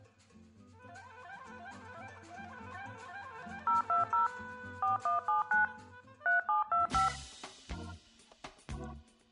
DTMF, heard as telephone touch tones, dialled by machine, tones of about 140 ms. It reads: 020 4179 3725